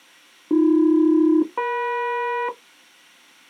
Aircraft SELCAL, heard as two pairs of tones. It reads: AB-EM